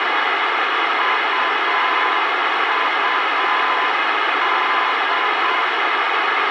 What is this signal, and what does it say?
Morse code, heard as a keyed tone, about 7 wpm, 1020 Hz, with radio hiss and a squelch burst at the end. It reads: UUD